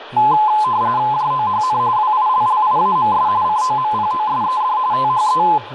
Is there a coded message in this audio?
Yes: RTTY (45.45 baud, 170 Hz shift) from 0.2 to 5.6 s, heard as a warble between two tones, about 940 Hz centre, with radio static and speech in English. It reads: JOHN WILLIAMS COMPOSED THE